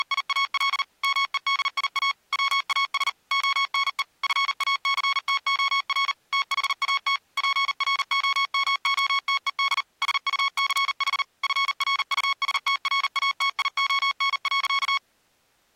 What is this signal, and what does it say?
Morse code, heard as electronic beeps, machine-sent, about 39 wpm, 1100 Hz. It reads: … MEDIA WAS ONE FACTOR THAT PROMOTED SUCH FRUSTRATION.